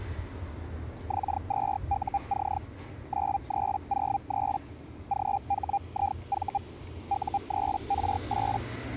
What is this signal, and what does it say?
Hellschreiber (Feld-Hell, 122.5 baud), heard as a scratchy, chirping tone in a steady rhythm, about 800 Hz, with the noise of a residential street. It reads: X2UC 9303 GHIV U3R8